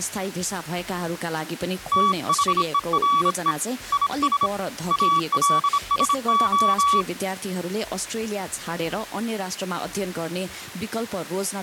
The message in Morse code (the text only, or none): THERE IS ALSO